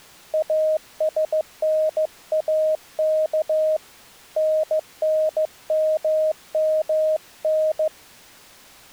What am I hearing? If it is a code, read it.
Morse code, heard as a keyed tone, hand-sent with a paddle, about 15 wpm, 620 Hz. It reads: ASNAK NNMMN